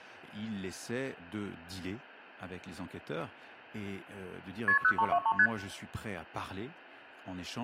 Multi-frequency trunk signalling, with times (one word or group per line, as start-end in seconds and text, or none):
4.7-4.8 KP
4.8-5.3 0323
5.4-5.5 ST